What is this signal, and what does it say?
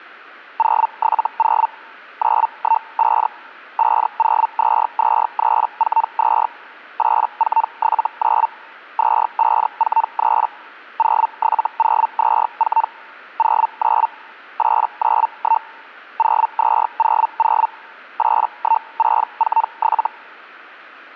Hellschreiber (Feld-Hell, 122.5 baud), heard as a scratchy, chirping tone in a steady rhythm, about 900 Hz. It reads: 070 915 5022342 8479 2543 07024 09 891 0200 81647